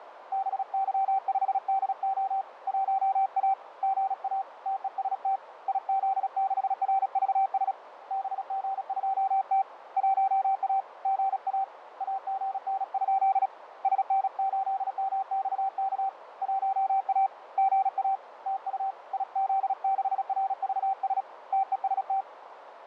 Morse code, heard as a keyed tone, hand-sent with a paddle, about 36 wpm, 780 Hz, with radio static, fading and a narrow filter. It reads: BY5DO 1A GA TEST IZ6RVS BG2T 1A GA AGN? SN8MXK 1A GA TU IZ6RVS TEST